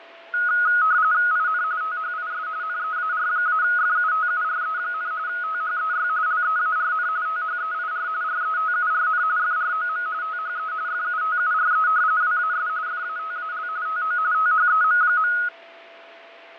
RTTY (45.45 baud, 170 Hz shift), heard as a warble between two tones, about 1360 Hz centre, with radio static, fading and a steady whistle near 670 Hz. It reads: IN THIS NEAR-FUTURE, THEY LEARN THEIR RETURN FROM THE FUTURE WAS FATAL TO THEM.